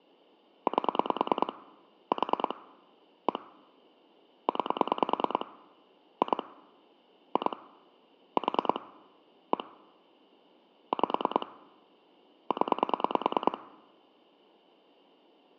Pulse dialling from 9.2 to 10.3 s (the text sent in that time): 1